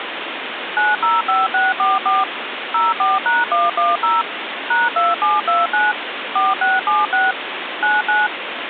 DTMF, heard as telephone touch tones, dialled by machine, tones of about 180 ms, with phone line noise. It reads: 905644 04#110 #2729 4676 99